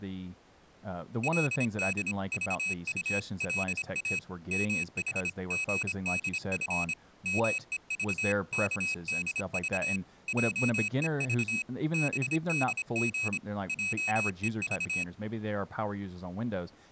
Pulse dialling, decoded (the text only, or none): none